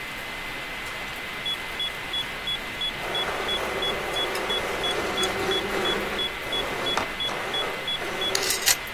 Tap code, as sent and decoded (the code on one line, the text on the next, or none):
none